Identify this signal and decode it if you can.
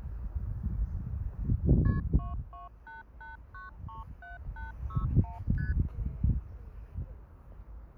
Multi-frequency trunk signalling (R1, as on North American trunks), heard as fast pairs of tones, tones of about 150 ms, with the noise of a park. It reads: KP 2288937861 ST